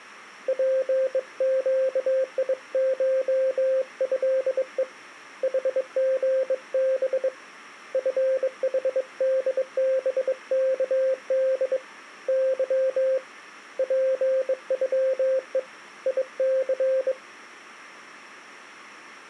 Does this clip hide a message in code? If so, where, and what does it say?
Yes: Morse code (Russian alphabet) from 0.4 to 17.2 s, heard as a keyed tone, hand-sent with a bug key, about 22 wpm, 530 Hz. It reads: ПЩИШЭЕ ХГБ ФХДБКД Ы ПЮЕ ИЦ